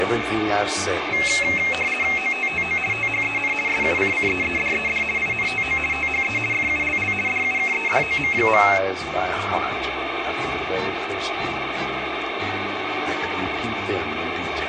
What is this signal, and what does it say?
RTTY (50 baud, 450 Hz shift), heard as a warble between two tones, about 2350 Hz centre, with radio static. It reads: OTTO THEN SUCCEEDED INTO THE FULL DUKEDOM.